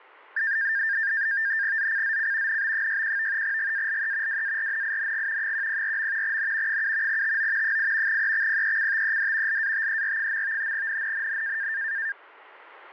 NAVTEX (SITOR-B), 100 baud, 170 Hz shift, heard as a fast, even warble, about 1700 Hz centre. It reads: ZCZC NB61 GALE WARNING 104. N 7 TO 8 EXPECTED LATER. NNNN